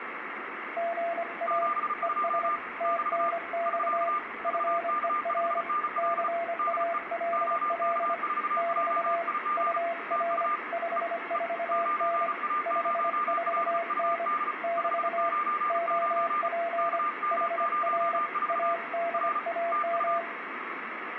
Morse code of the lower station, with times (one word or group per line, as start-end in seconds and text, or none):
0.8-1.7 GA
2.0-2.5 ES
2.8-4.1 TNX
4.4-5.6 FER
6.0-8.1 CALL
8.6-9.2 <BT>
9.6-10.5 UR
10.7-12.3 54N
12.7-14.3 54N
14.6-15.3 <BT>
15.7-17.0 OP
17.3-18.2 HR
18.5-20.2 ADAM